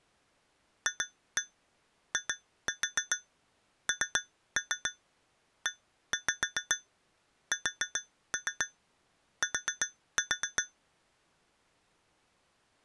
Tap code, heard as taps on glass, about 7 knocks a second. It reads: FINEST